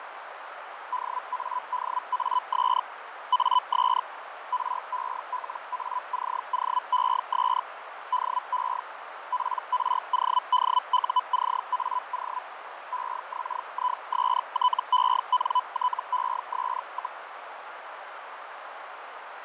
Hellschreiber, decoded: DADAS AS RELACOES DE PRODUCAO EXISTENTES,

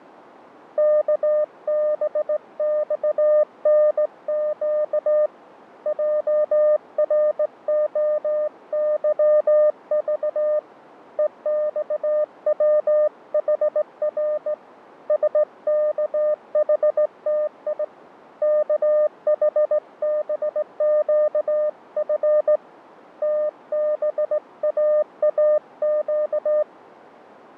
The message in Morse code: KBXNQ JROYV EXWHR SKHTI KHBQF TBAAQ

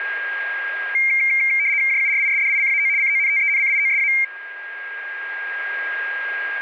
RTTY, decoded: JURISDICAO CONTENCIOSA

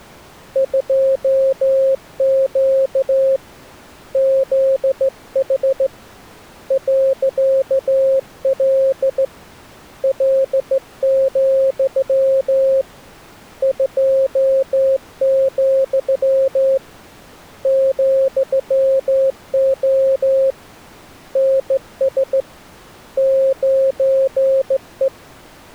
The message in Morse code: 2Q ZH .L L, 2, ,O NS 9E

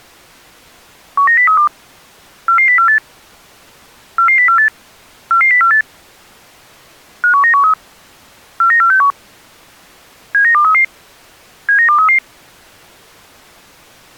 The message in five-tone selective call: 19032 44048 44048 44048 51913 49461 79233 79233

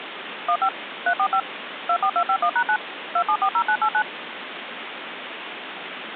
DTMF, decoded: 15 345 24251#9 2740989

